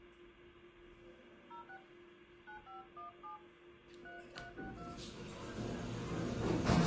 DTMF, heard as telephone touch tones, dialled by hand, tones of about 140 ms, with phone line noise and the noise inside a lift. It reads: 06 9517 3362